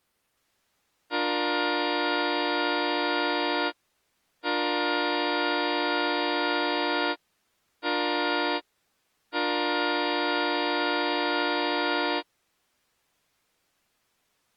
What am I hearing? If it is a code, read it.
Train horn signal, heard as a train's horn. 2 long, 1 short, 1 long. On North American railways: approaching a public crossing.